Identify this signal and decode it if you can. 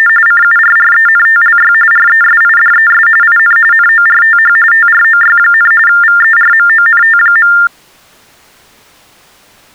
TTY/TDD text telephone tones (45.45 baud Baudot), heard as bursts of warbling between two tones, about 400 Hz shift, 1600 Hz centre. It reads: … CURRENTLY RESIDES IN NORTH TROY, VERMONT.